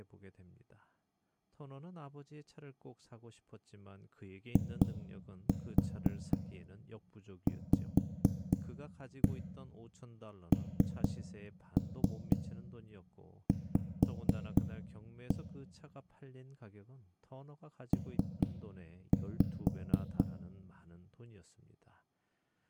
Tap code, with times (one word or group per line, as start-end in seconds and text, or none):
4.6-15.4 IVNV
17.9-20.2 P